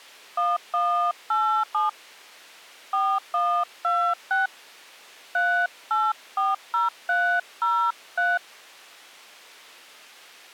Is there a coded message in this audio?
Yes: DTMF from 0.4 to 8.4 s, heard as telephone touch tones, dialled by hand, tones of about 260 ms. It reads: 1187 4126 3840303